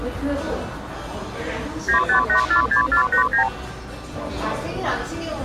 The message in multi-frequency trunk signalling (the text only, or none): 95846489